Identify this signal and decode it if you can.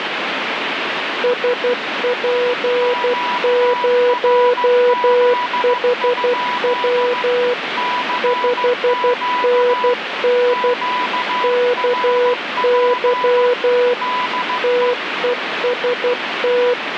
Morse code, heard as two keyed tones, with radio static. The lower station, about 12 wpm, 490 Hz: SP0HW 5NN KY TEST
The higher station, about 15 wpm, 990 Hz: QRZ? CQ QRP DE